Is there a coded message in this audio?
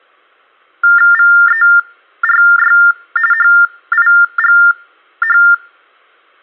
Yes: TTY/TDD text telephone tones (45.45 baud Baudot) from 0.8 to 5.5 s, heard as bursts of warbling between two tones, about 400 Hz shift, 1600 Hz centre. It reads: VERY HIGH